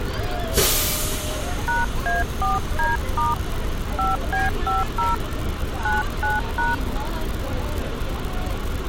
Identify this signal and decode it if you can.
DTMF, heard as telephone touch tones, dialled by hand, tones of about 170 ms, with street noise. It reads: #A4D* 5B50 99#